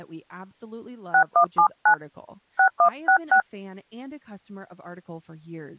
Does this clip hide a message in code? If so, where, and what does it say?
Yes: DTMF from 1.1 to 3.4 s, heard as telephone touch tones, dialled by hand, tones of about 90 ms, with speech in English. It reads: 6179 6166